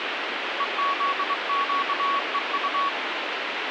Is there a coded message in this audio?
Yes: Morse code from 0.5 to 2.9 s, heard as a keyed tone, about 23 wpm, 1120 Hz, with radio static. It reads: EZQEU